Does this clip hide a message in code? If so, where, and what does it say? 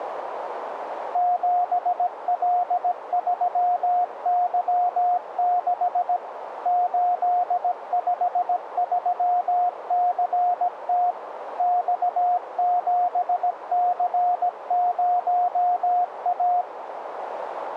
Yes: Morse code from 1.1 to 16.7 s, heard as a keyed tone, machine-sent, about 17 wpm, 720 Hz, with radio static and a narrow filter. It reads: 7L3Y6 853CT X7C0A